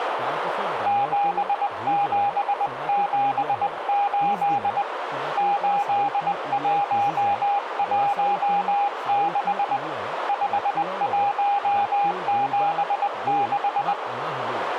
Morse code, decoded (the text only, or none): 7778 8116 5176